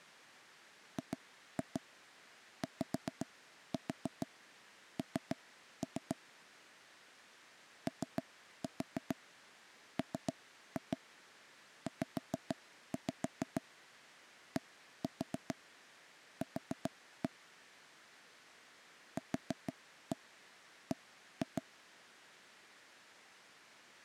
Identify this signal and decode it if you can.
Tap code, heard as knocks on wood, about 6 knocks a second. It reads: GYN OMZDQ QB